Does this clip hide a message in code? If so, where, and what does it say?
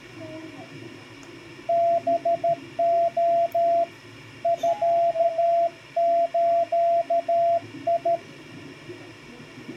Yes: Morse code (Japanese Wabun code) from 1.6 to 8.2 s, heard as a keyed tone, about 13 wpm, 680 Hz, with the noise inside a subway train. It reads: ハレ ミズ